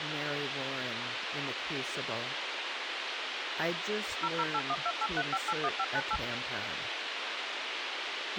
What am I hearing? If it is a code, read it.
DTMF, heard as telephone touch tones, dialled by machine, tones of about 50 ms, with radio hiss and speech in English. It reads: 0081283581598